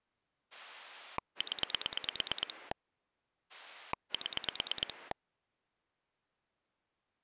Pulse dialling, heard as a rotary dial, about 9 pulses a second. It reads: 0 7